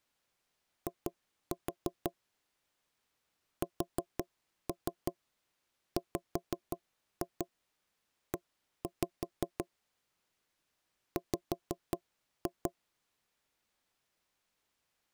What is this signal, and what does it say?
Tap code, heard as knocks on wood, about 5 knocks a second. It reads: I SWE W